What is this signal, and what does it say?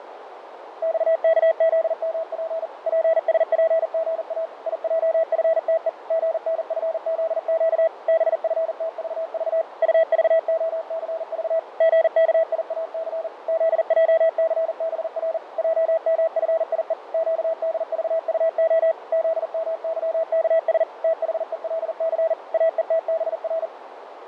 Morse code, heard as a keyed tone, machine-sent, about 40 wpm, 650 Hz, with radio static, fading and a narrow filter. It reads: XKZMP PSPGA IJFTE GNFZQ BFTVV UVOCV GKIAC ZJCBR JMFIE QDVUO ZMYKS THELC AETBR